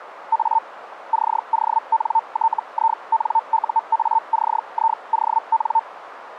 Hellschreiber (Feld-Hell, 122.5 baud), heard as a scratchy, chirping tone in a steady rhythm, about 900 Hz, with radio static. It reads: A CONTINUACION